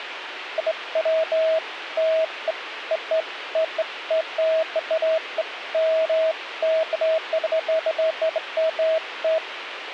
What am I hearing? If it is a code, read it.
Beeps of irregular length, with radio hiss. There is no code.